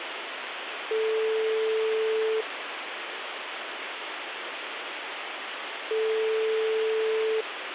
Telephone call progress tone (single-tone plan, as in most of Europe), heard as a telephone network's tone, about 440 Hz, 1.5 s on and 3.5 s off, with phone line noise. Ringback tone.